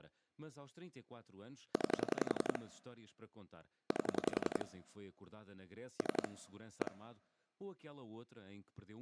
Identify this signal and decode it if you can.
Pulse dialling, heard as clicks on a phone line, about 11 pulses a second, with speech in Portuguese. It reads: 9 8 3 1